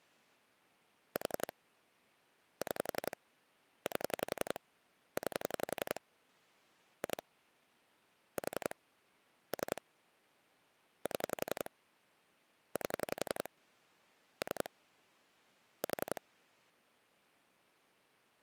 Pulse dialling, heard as clicks on a phone line, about 11 pulses a second. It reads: 4 6 8 9 2 4 3 7 8 3 4